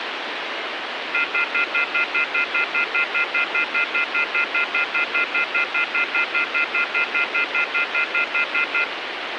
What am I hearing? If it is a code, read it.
Telephone call progress tone (North American plan), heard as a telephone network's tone, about 1400, 2050, 2450, 2600 Hz, 0.1 s on and 0.1 s off, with phone line noise. Off-hook warning tone.